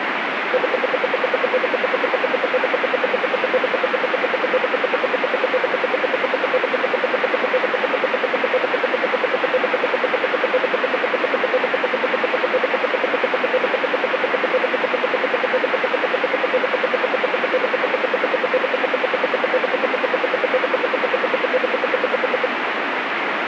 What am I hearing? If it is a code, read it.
Radio time signal (RWM, Moscow), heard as ten pulses a second, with radio static.